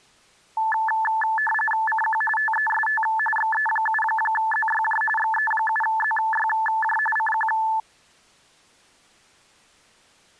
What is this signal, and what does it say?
RTTY (45.45 baud, 850 Hz shift), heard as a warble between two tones, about 1310 Hz centre. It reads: CQ TEST XE7ZYJ XE7ZYJ CQ